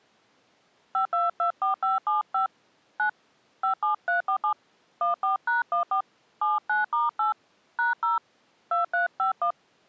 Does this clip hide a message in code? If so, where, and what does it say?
Yes: DTMF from 0.9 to 9.5 s, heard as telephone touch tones, dialled by hand, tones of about 130 ms. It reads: 5224575 9 57347 14#14 79*8 #0 2351